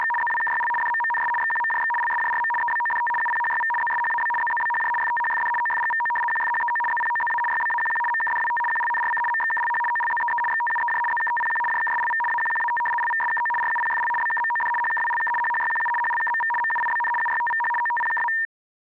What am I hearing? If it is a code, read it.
RTTY (75 baud, 850 Hz shift), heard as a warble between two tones, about 1380 Hz centre. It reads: … ZWKYL DMMNS XQMJX LSJRM EBODT UPHYV ZSHAB ZZBHJ FTHFD OFGVO QFHEO ZPOZA YBAQQ MKDWT QLNRC MXKLH OLZEE XTUEJ ZKTPQ JKSLV AQQAT LVSKO RUPFL BKMOD HKWLK HHYQU HLKMV MUIBN UYTVH OTPKA